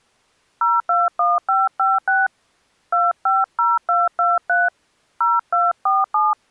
DTMF, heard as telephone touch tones, dialled by hand, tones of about 190 ms. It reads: 021556 250223 0247